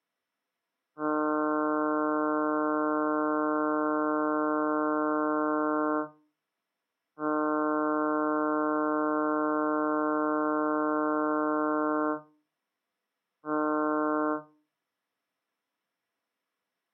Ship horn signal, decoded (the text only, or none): 2 long, 1 short